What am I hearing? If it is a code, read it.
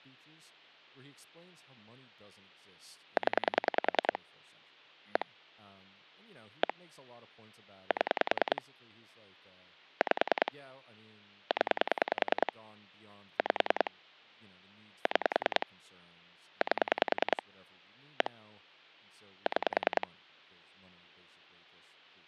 Pulse dialling, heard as clicks on a phone line, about 10 pulses a second, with speech in English. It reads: 0 1 1 7 5 0 5 6 8 1 6